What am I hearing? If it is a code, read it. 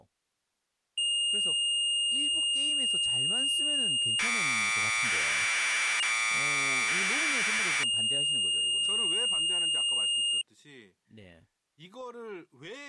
Commodore tape loading (standard loader), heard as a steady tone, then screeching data, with speech in Korean.